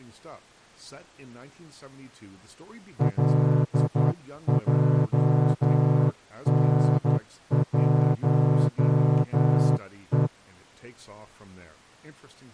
Morse code, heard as a horn, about 11 wpm, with speech in English. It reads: LJN1E